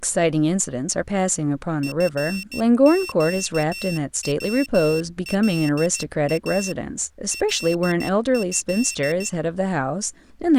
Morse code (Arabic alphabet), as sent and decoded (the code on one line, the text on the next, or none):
..-. --.- .-- .-.. .- / .-.. ..-..
فقولا له